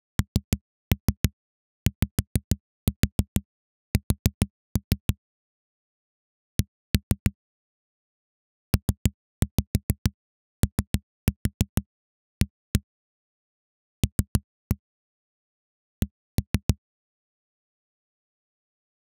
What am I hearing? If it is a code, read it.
Tap code, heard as knocks on a wall, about 6 knocks a second. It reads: NYS C POA L C